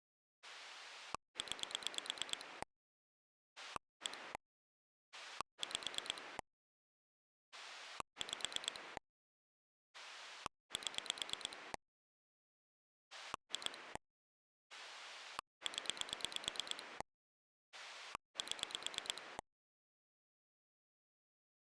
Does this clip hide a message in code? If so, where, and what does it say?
Yes: pulse dialling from 0.4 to 19.4 s, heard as a rotary dial, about 9 pulses a second. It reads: 9 1 5 5 7 2 0 7